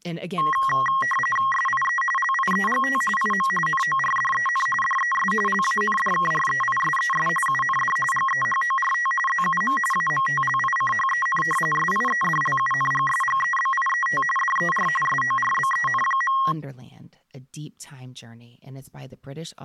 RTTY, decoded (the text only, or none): SIE LIEGT IM NORDEN DES LANDKREISES UND GEHORT ZUM AMTLICHEN SIEDLUNGSGEBIET DER SORBEN.